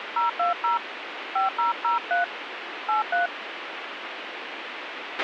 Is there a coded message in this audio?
Yes: DTMF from 0.2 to 3.3 s, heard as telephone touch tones, dialled by hand, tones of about 140 ms, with radio hiss and a squelch burst at the end. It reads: 020 5003 83